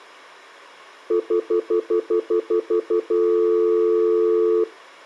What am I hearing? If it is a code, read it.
Telephone call progress tone (North American plan), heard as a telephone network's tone, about 350, 440 Hz, 0.1 s on and 0.1 s off. Stutter dial tone.